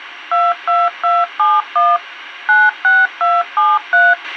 DTMF, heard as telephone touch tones, dialled by machine, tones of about 210 ms, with a squelch burst at the end. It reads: 22271 96273